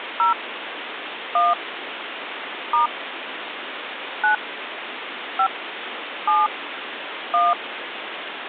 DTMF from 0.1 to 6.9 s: 0 1 * 9 5 7

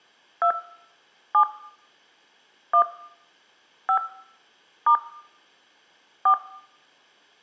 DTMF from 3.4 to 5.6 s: 5 *

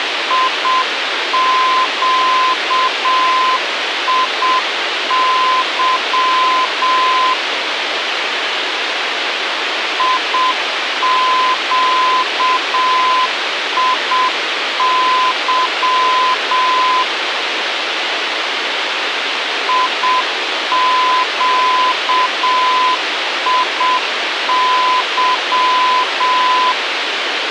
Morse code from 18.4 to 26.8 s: IQIY

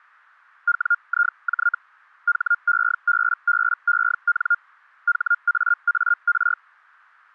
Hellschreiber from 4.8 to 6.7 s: HAAR

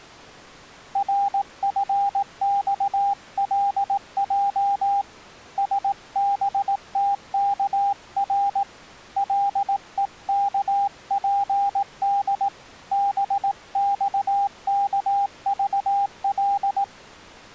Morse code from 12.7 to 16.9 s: BXKVL

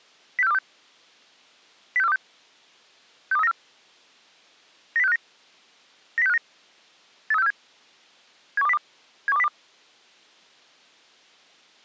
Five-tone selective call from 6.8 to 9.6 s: 83647 71202 71202

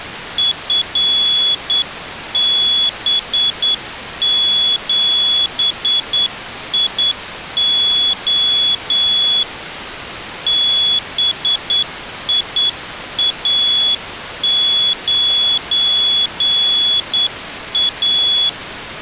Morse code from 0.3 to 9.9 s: FB7IO

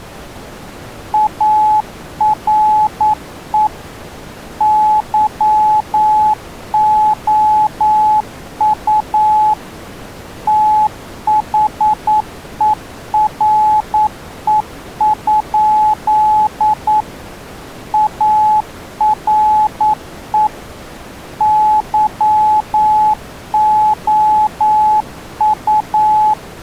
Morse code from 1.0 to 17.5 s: ARE YOU THERE?

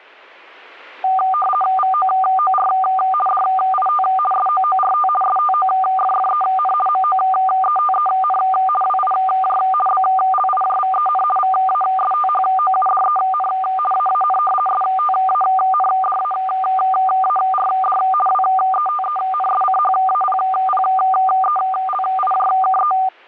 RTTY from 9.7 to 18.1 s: BLIJVEN VASTHOUDEN AAN STANDAARD

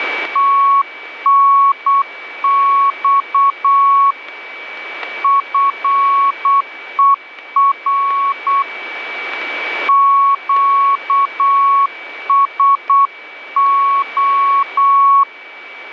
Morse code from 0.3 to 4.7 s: TNX

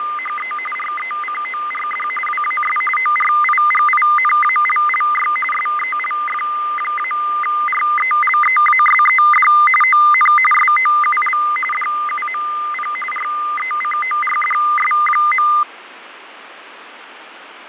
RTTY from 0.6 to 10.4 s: RECORD WAS ORIGINALLY SELF-RELEASED ON

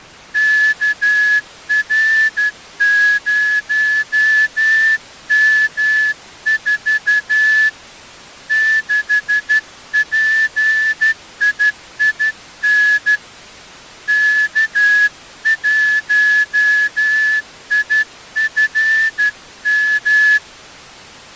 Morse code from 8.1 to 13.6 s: 6PIIN

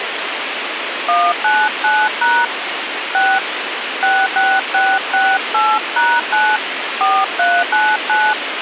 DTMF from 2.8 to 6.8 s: 6 66668#9

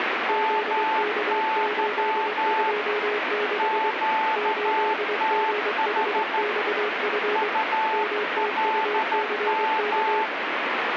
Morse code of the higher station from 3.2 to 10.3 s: QTH ULM

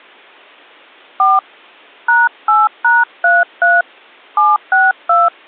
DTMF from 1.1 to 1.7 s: 4

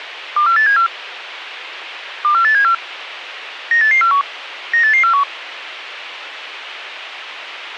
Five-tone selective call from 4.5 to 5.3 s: 98841

